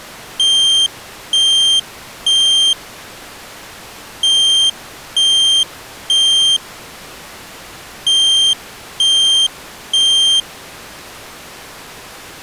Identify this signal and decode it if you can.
Alarm pattern, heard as an alarm's beeps, played three times, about 3150 Hz. Temporal three. Smoke or fire, evacuate.